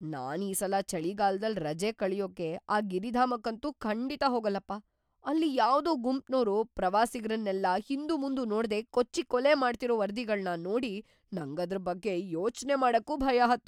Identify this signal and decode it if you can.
Speech in Kannada. There is no code.